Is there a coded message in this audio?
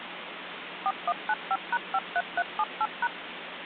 Yes: DTMF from 0.9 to 3.1 s, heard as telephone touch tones, dialled by machine, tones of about 50 ms, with phone line noise. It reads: 4195#53378#